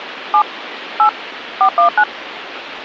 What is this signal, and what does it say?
DTMF, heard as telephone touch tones, dialled by hand, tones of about 90 ms, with phone line noise. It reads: 7 8 419